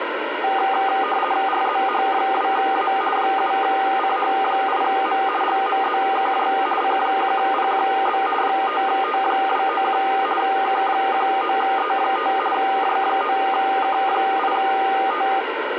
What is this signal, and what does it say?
RTTY (50 baud, 450 Hz shift), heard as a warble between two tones, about 1000 Hz centre, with radio static. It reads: RZH2A 7CH8M GMZKJ C1PQB 5T291 K19E5 J9K8T